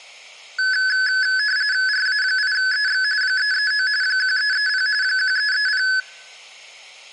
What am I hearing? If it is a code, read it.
RTTY (45.45 baud, 170 Hz shift), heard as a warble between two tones, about 1600 Hz centre, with room echo. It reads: RA8EX 339 1330 1330